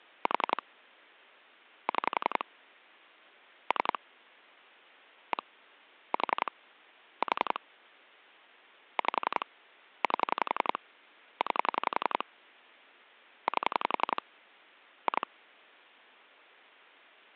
Pulse dialling, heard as clicks on a phone line, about 11 pulses a second. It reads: 4 6 3 1 4 4 5 8 9 8 2